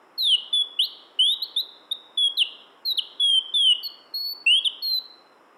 Bird-like chirps, with room echo. There is no code.